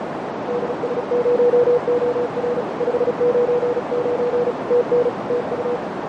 Morse code, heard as a keyed tone, hand-sent with a paddle, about 36 wpm, 490 Hz, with heavy radio static, fading and a narrow filter. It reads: DS0OR 599 TN TU